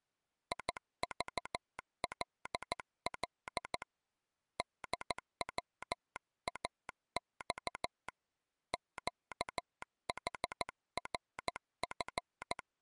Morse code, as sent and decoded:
.. ...- .-.. .-.. / -.. .-- .- -..- / --.- .... .-. ..-.
IVLL DWAX QHRF

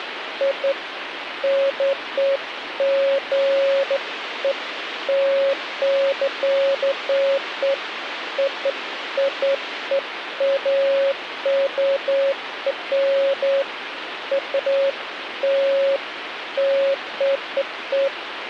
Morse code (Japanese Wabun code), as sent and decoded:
none

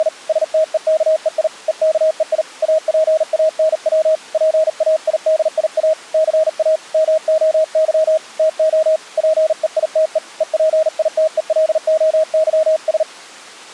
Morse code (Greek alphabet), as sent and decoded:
… / ... - . -.- . .. / . -.- . .. / .- .--. .- -. .-- / .--. .- .. -.. .. .- / -.-. .- / -- --- -.-- / - --- / .--. . .. - . / . .--. .. - . .-.. --- -.-- ...
… ΣΤΕΚΕΙ ΕΚΕΙ ΑΠΑΝΩ ΠΑΙΔΙΑ ΘΑ ΜΟΥ ΤΟ ΠΕΙΤΕ ΕΠΙΤΕΛΟΥΣ

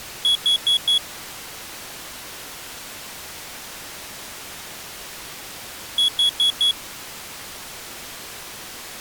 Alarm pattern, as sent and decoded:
4 beeps and a pause
temporal four

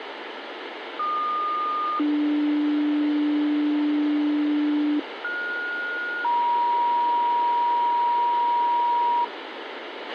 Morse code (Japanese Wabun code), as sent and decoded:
none

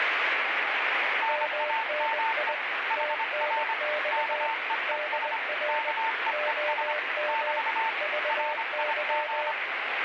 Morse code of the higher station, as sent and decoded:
-. .- -- . / .... .-. / -.- . . ... / -.- . . ... / -...- / .-. .. --.
NAME HR KEES KEES <BT> RIG

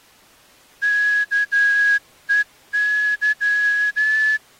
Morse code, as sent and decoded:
-.- . -.--
KEY

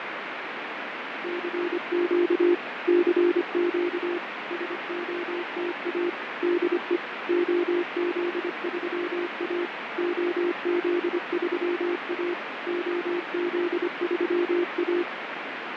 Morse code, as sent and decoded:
-.-. --.- / -.-. --.- / ... --- - .- / -.. . / --- --.. ...-- .- / --- --.. ...-- .- / --- --.. ...-- .-
CQ CQ SOTA DE OZ3A OZ3A OZ3A

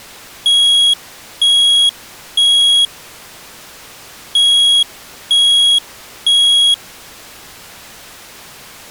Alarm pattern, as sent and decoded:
3 beeps and a pause
temporal three

